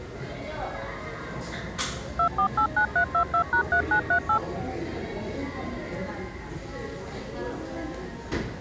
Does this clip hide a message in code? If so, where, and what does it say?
Yes: DTMF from 2.2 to 4.4 s, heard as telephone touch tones, dialled by machine, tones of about 90 ms, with the noise of a cafe. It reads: 2489322#3938